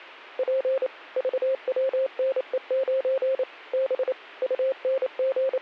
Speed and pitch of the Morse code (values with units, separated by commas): 28 wpm, 530 Hz